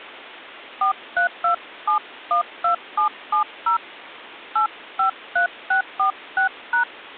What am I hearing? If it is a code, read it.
DTMF, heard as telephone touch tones, dialled by hand, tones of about 110 ms. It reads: 432712770 853646#